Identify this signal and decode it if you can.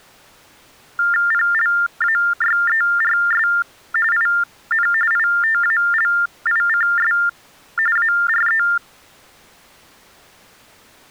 TTY/TDD text telephone tones (45.45 baud Baudot), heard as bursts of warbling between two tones, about 400 Hz shift, 1600 Hz centre. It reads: PLAYERS IN ITALICS ARE